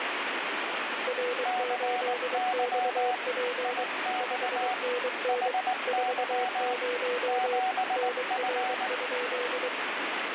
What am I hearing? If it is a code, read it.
Morse code, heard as two keyed tones, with heavy radio static. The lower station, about 23 wpm, 490 Hz: R8XP 5NN 40 NR?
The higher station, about 19 wpm, 740 Hz: CY IX HY 7F